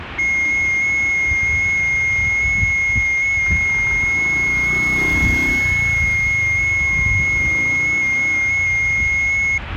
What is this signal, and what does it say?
FT8 (one signal), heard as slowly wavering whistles, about 6.25 baud, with the noise of a residential street.